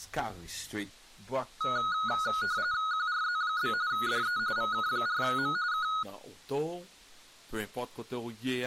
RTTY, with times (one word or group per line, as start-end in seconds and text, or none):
2.9-3.7 QRZ?
3.9-4.4 DE
4.6-5.6 VK4M
5.7-5.9 K